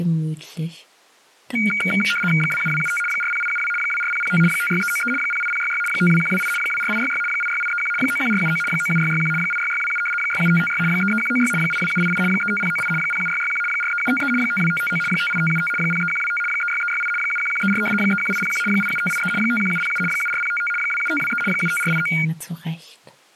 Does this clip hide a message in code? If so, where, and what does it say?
Yes: RTTY (75 baud, 850 Hz shift) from 1.6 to 22.3 s, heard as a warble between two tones, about 1850 Hz centre. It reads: 27275 40872 24005 56393 08066 52128 24866 86831 91479 97661 86627 67556 33196 82788 35098 07661 43753 52559 58575 03125 36368 71134 31801 87583 51707 74055 27523 75489